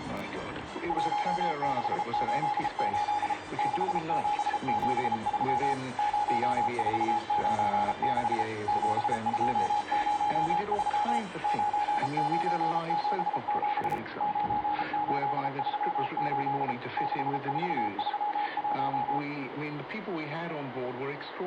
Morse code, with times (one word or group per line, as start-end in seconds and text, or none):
0.9-3.3 1688
3.6-5.7 6773
6.0-8.4 0496
8.7-11.2 7203
11.4-14.0 9977
14.2-16.7 9838
17.0-19.2 6431